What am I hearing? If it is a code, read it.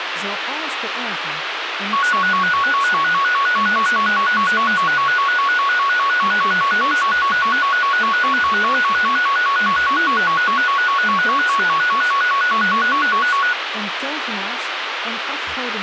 A tone that alternates evenly between two pitches, with radio hiss and speech in Dutch. There is no code.